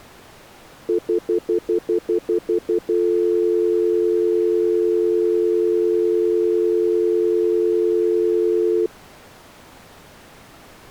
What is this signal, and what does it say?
Telephone call progress tone (North American plan), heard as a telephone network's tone, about 350, 440 Hz, 0.1 s on and 0.1 s off. Stutter dial tone.